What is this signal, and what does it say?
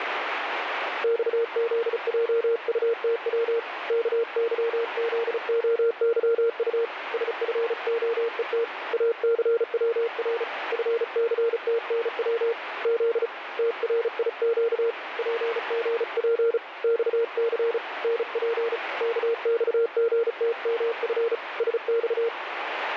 Morse code, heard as a keyed tone, hand-sent with a paddle, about 35 wpm, 460 Hz, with radio static. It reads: XZJUTW KYZOYU SFOET ACWR FCTNW Z TRIQ PGP XC NP KXGTMF SX